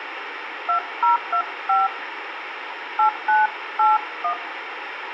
DTMF, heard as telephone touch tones, dialled by hand, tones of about 120 ms, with radio hiss. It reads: 2025 8981